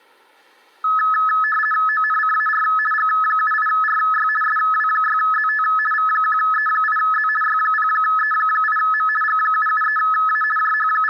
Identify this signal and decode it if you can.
RTTY (50 baud, 450 Hz shift), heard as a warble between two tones, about 1500 Hz centre, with room echo. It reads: ONCAR G78RY SW6ZT V1E8Z Y0E8M G773A …